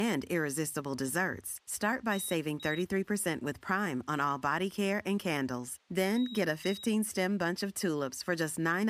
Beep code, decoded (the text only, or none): 2 short